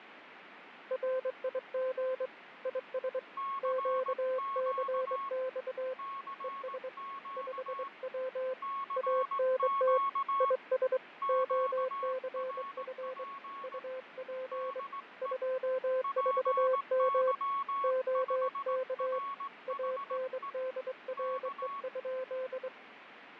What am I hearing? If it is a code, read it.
Morse code, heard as two keyed tones, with radio static and fading. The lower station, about 23 wpm, 520 Hz: RIG IS QCX ES 5W ANT IS OCF UP 24M OK ANDRE?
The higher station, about 18 wpm, 1100 Hz: CQ CQ CQ QRP DE PY5RHE K